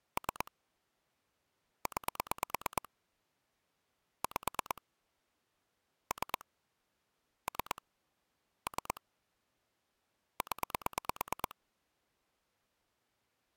Pulse dialling, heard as clicks on a phone line, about 9 pulses a second. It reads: 3 9 5 3 3 3 0